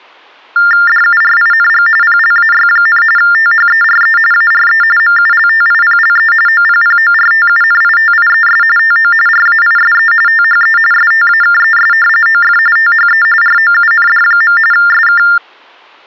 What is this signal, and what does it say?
TTY/TDD text telephone tones (45.45 baud Baudot), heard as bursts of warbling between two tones, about 400 Hz shift, 1600 Hz centre. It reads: DURING PLAY, THERE ARE MULTIPLE OPPORTUNITIES TO RAISE THE STAKES OF THE ROUND. SK